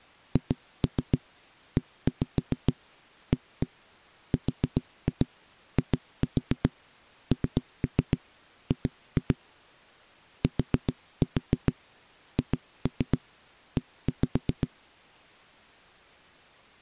Tap code, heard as knocks on wood, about 7 knocks a second. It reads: HEARING THE